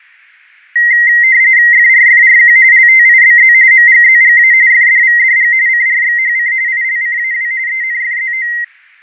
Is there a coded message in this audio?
Yes: RTTY (45.45 baud, 170 Hz shift) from 0.8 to 8.6 s, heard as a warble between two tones, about 2000 Hz centre, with fading. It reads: FRFRQ LTIBZ MGZGA FDVDG CRXHC ILCAW ENFZO